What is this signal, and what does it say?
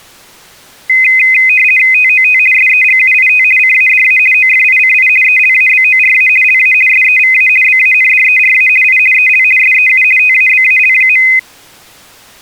RTTY (50 baud, 450 Hz shift), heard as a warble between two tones, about 2300 Hz centre. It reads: TOT SEGUIT CADA OFICI ELABORA LA SEVA BANDERA I EL SEU TABAL.